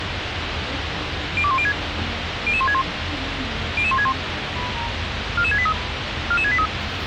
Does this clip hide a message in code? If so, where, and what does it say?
Yes: five-tone selective call (ZVEI) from 1.4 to 6.7 s, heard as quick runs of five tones, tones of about 70 ms, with radio hiss and the noise inside a bus. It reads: 02106 00161 00161 44683 44683